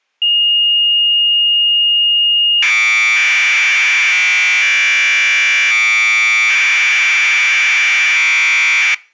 Commodore tape loading (standard loader), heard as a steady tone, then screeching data.